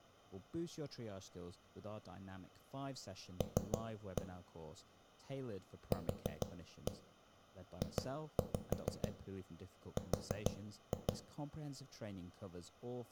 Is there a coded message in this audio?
Yes: tap code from 3.4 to 11.1 s, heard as knocks on a wall, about 6 knocks a second, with room echo and speech in English. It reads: L QJR